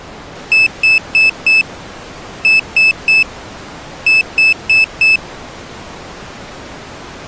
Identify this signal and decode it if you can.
Beep code, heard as a piezo beeper, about 2600 Hz. 4-3-4. In Phoenix BIOS tables: time-of-day clock failure.